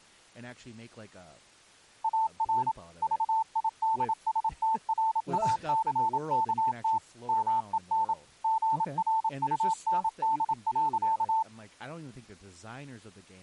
Morse code, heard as a keyed tone, machine-sent, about 27 wpm, 890 Hz, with speech in English. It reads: AR VIDSTRACKT MEN GRUND.